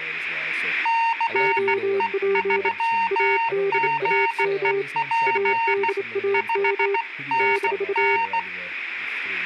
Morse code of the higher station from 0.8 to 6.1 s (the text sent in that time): CE3GEP